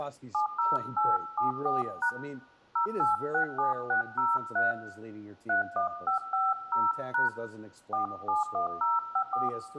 DTMF, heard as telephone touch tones, dialled by hand, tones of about 140 ms, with room echo and speech in English. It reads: 70874# 0867603 31550# 471054